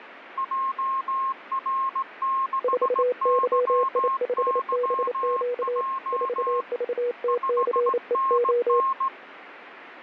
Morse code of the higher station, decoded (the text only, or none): JR6YYJ 5NN